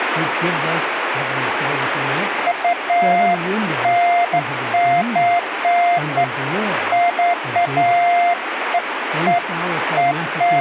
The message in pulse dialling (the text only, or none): none